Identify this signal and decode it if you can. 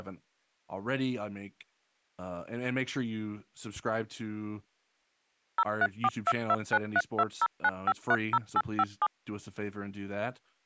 DTMF, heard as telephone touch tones, dialled by machine, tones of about 50 ms, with speech in English. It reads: 0342293209530857